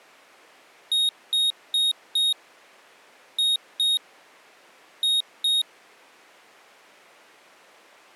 Beep code, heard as a piezo beeper, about 3750 Hz. 4-2-2. In Phoenix BIOS tables: shutdown test failure.